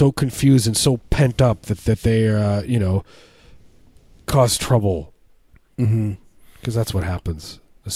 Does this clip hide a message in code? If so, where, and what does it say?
No, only speech in English.